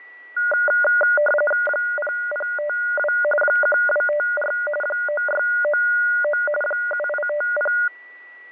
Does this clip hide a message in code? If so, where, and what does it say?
Yes: RTTY (45.45 baud, 850 Hz shift) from 0.4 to 7.9 s, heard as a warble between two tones, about 1020 Hz centre, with fading, static crashes and a steady whistle near 1950 Hz. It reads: 0052 1254 9699 7850